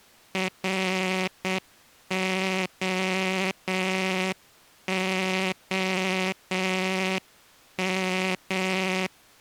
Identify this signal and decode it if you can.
Morse code, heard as a buzzer, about 8 wpm. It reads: ROOM